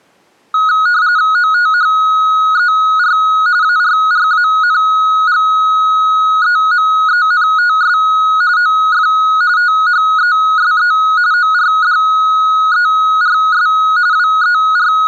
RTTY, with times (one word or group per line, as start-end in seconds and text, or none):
1.4-3.2 OTHER
3.6-8.0 ARRANGEMENTS
8.6-9.1 OF
9.6-10.9 THESE
11.3-13.7 ORDERS
14.1-15.1 …